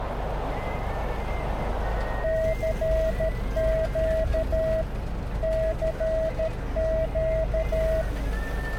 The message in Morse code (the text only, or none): CQ CQ